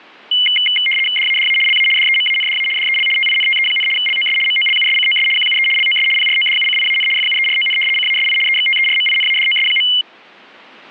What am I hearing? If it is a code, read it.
RTTY (75 baud, 850 Hz shift), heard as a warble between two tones, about 2550 Hz centre. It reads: DADA LA DEMANDA DEL TINTE, LOS MOLUSCOS QUE LOS PRODUCIAN FUERON CASI EXTERMINADOS.